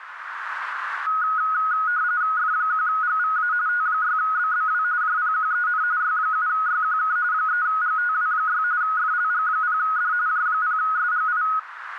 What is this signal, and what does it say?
RTTY (45.45 baud, 170 Hz shift), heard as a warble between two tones, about 1360 Hz centre, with radio static and a narrow filter. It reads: F1GVA T6BBW JPQEN Y7YQK 3GTW6 FLG0D J0SGI